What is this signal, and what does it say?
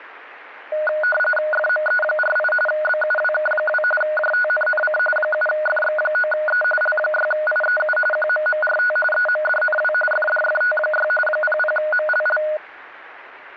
RTTY (45.45 baud, 850 Hz shift), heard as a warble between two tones, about 1040 Hz centre, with radio static. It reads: FME48 BUWK2 JTNNC 7FX9E L6IEU QMMRT EMDNW FDFT6 00MLL